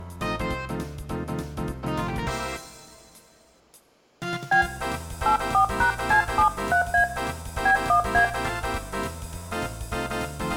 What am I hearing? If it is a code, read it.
DTMF, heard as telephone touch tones, dialled by hand, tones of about 100 ms, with room echo. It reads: B 84#C73A B1A